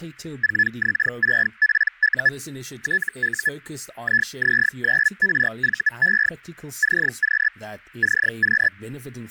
Hellschreiber (Feld-Hell, 122.5 baud), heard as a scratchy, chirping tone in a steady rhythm, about 1700 Hz, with speech in English. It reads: 4X6PU TU IZ9RVE CQ CQ